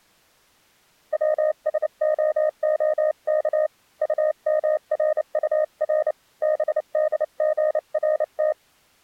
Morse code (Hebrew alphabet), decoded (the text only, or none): צשההך טמרטר בדגרת